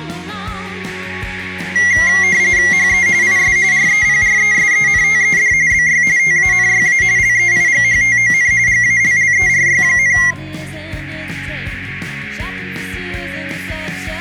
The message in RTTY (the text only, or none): HE IS REPRESENTED BY TANYA LEIGHTON GALLERY,